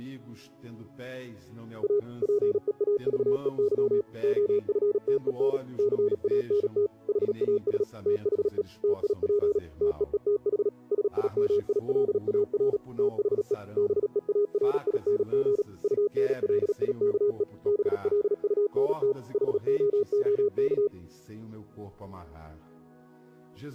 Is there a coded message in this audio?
Yes: Morse code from 1.8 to 20.9 s, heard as a keyed tone, machine-sent, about 37 wpm, 410 Hz. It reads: A PEAVEY OFTEN CANT HAS THE TIP TEETH SIMILAR THE BEARING UNLIKE BLUNT HOOK